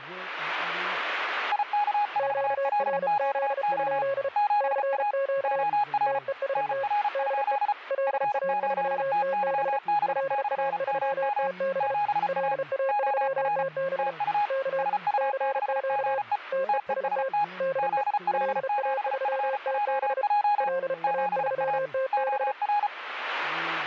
Morse code, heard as two keyed tones. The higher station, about 34 wpm, 830 Hz: IK4LQO 7A OR NR? F8TYB/MM 7A OR TU SU6GE TEST ZL7FJJ 7A OR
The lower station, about 33 wpm, 540 Hz: QRZ? CQ TEST DE LA3TB LA3TB LA3TB K CQ TEST DE LA3TB LA3TB